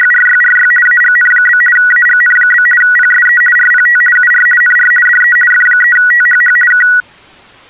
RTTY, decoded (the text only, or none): … AGN? AGN? PSE RPT UR NR DE F3THH K